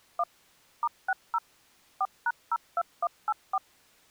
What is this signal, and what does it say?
DTMF, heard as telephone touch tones, dialled by machine, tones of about 50 ms. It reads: 1 *60 4#02184